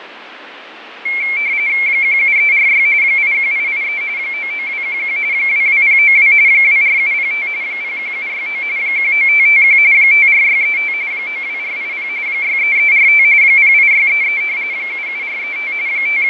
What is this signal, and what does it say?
RTTY (45.45 baud, 170 Hz shift), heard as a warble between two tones, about 2250 Hz centre, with radio static and fading. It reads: 17346 81883 99211 22092 24705 01769 19551 54635 92480 63345 08633 77435 …